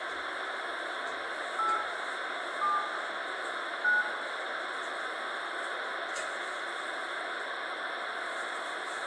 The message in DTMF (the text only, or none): 8 7 9